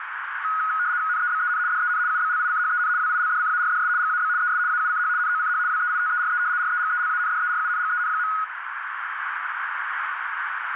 RTTY (75 baud, 170 Hz shift), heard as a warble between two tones, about 1360 Hz centre, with radio static and a narrow filter. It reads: NEBEN DEN UBLICHEN WILDCARDS GAB ES AUCH NOCH WEITERE REGELANDERUNGEN.